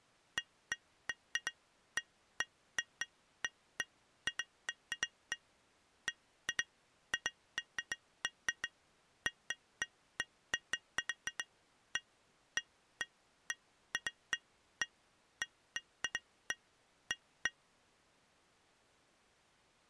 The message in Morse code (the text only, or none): none